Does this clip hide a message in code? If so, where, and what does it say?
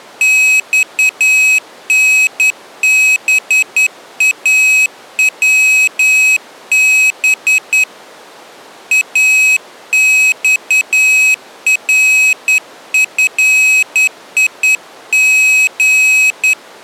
Yes: Morse code (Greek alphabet) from 0.2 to 16.6 s, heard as a high beeper, hand-sent with a straight key, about 10 wpm, 2550 Hz. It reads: ΞΝΒΑΩΒ ΑΞΡΦΙΓ